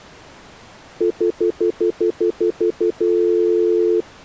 Telephone call progress tone (North American plan), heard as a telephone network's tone, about 350, 440 Hz, 0.1 s on and 0.1 s off. Stutter dial tone.